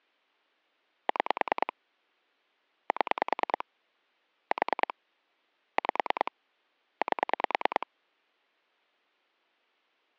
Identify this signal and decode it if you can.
Pulse dialling, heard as clicks on a phone line, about 9 pulses a second. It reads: 6 7 4 5 8